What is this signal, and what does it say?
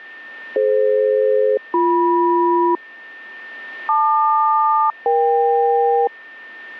Aircraft SELCAL, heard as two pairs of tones, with a steady whistle near 1810 Hz. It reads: DF-BM LQ-EK